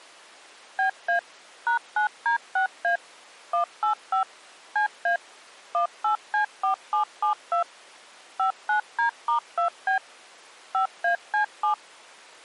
DTMF, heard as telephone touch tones, dialled by machine, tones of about 110 ms. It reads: BA #9D6A 185 CA 18C4772 59D*2B 5AC7